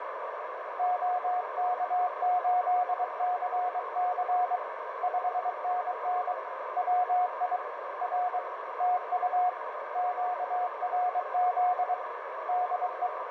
Morse code, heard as a keyed tone, hand-sent with a paddle, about 23 wpm, 720 Hz, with radio static and a narrow filter. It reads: OK8CC 5NN WI R TU QRZ DE